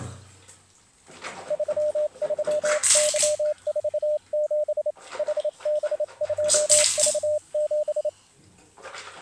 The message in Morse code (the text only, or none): 33Y47 HB2V7